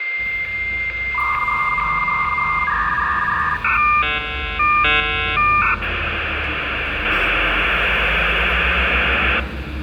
Dial-up modem handshake (V.34 or later), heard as a whistle, warbles, then hiss, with phone line noise, room echo and street noise.